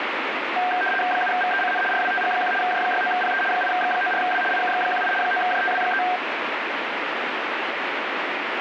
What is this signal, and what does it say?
RTTY (75 baud, 850 Hz shift), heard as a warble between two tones, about 1150 Hz centre, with radio static. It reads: 7VECN RWTG1 J69PE 8X94W IKX18 9JTW3